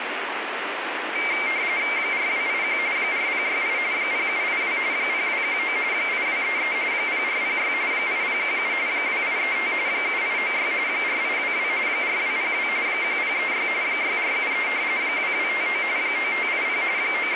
RTTY (45.45 baud, 170 Hz shift), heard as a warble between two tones, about 2200 Hz centre, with radio static. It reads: 4281 4068 0782 0219 8233 0406 8017 2835 7896 4822 4202 1036 6473 2259 9580 …